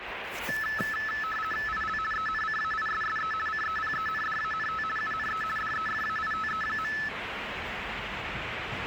RTTY (50 baud, 450 Hz shift), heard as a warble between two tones, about 1500 Hz centre, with radio static and the noise of a residential street. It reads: IL ENCAISSE CEPENDANT UNE DEFAITE.